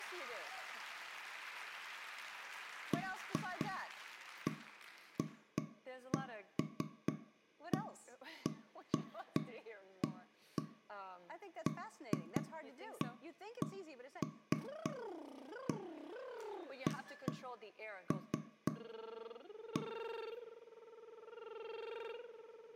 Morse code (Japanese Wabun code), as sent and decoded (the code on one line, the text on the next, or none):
none